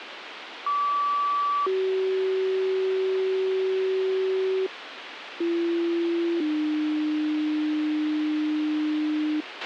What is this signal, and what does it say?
Two-tone page, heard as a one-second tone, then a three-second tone, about 1150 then 380 Hz, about 340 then 300 Hz, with radio hiss and a squelch burst at the end.